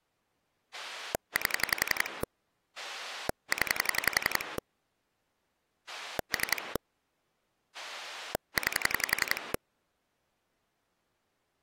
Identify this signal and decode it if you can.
Pulse dialling, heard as a rotary dial, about 11 pulses a second. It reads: 8 0 3 9